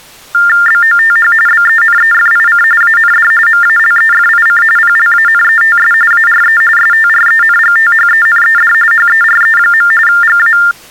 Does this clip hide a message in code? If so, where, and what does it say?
Yes: TTY/TDD text telephone tones (45.45 baud Baudot) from 0.3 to 10.7 s, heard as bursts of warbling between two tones, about 400 Hz shift, 1600 Hz centre. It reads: BOTH BENEFIC AND MALEFIC PLANETS ARE STRENGTHENED HERE. GA